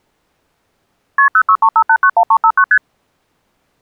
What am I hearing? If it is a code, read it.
Multi-frequency trunk signalling (R1, as on North American trunks), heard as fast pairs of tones, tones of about 70 ms. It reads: KP 0635891359 ST